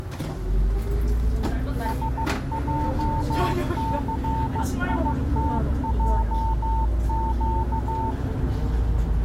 Morse code, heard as a keyed tone, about 15 wpm, 900 Hz, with the noise inside a bus. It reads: SJCITJQ